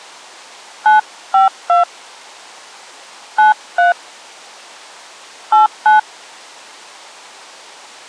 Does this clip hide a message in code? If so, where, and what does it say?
Yes: DTMF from 0.9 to 6.0 s, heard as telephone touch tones, dialled by hand, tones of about 140 ms. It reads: 952 93 89